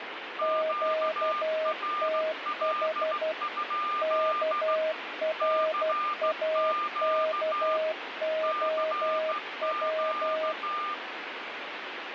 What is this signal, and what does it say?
Morse code, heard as two keyed tones, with radio static. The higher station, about 15 wpm, 1200 Hz: QRL? CQ CQ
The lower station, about 12 wpm, 630 Hz: QTH KRAKOW